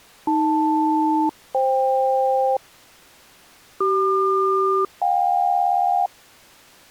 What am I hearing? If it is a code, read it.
Aircraft SELCAL, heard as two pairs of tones. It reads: AL-FK CQ-JK